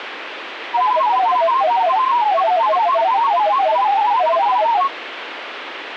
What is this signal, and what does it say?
Multi-tone FSK (Olivia or MFSK type), about 500 Hz wide, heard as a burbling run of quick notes, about 31.25 baud, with radio static.